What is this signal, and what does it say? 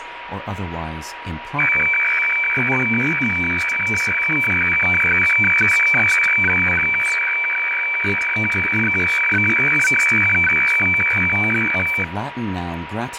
Weather fax (radiofax), 120 lines a minute, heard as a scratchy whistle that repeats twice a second, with radio static, a steady whistle near 960 Hz and speech in English.